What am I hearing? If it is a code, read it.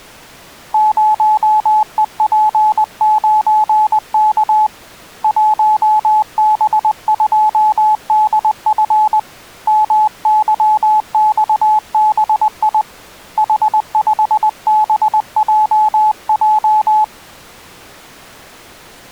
Morse code, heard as a keyed tone, hand-sent with a paddle, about 20 wpm, 860 Hz. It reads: 0EP9K 1B2DF MYXBI H5BJJ